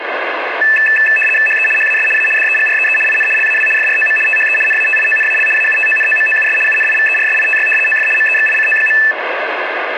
RTTY (75 baud, 850 Hz shift), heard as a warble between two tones, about 2200 Hz centre, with radio static. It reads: HE HAS A DEGREE IN LAW FROM THE NATIONAL AUTONOMOUS UNIVERSITY OF MEXICO.